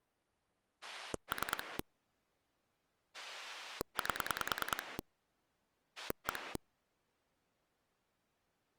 Pulse dialling, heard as a rotary dial, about 10 pulses a second. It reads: 3 8 1